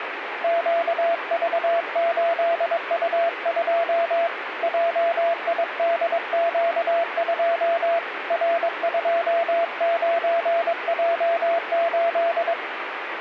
Morse code, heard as a keyed tone, hand-sent with a paddle, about 22 wpm, 680 Hz, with radio static. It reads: QV8U2 JIDQ2 R29J8